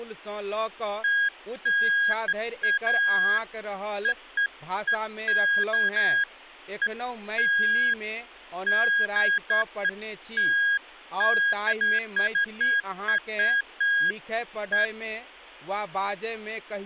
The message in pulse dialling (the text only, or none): none